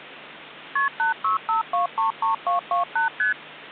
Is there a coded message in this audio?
Yes: multi-frequency trunk signalling (R1, as on North American trunks) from 0.8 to 3.3 s, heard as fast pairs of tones, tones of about 130 ms. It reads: KP 865233228 ST